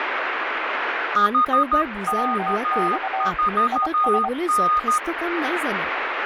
Morse code, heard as two keyed tones, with radio static and speech in Assamese. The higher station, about 13 wpm, 1230 Hz: HK4N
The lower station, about 24 wpm, 770 Hz: WX IS